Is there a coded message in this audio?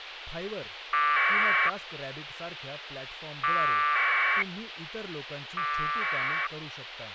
Yes: packet radio (AX.25, as in APRS), 1200 baud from 0.9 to 6.5 s, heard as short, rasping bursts, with radio hiss and speech in Marathi.